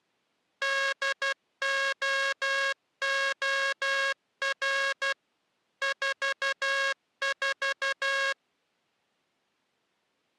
Morse code, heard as a buzzer, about 12 wpm. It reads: DOOR 44